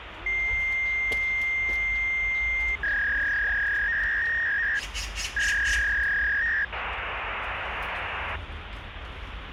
Fax machine handshake, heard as a long tone, a warble and hiss, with phone line noise and the noise of a residential street.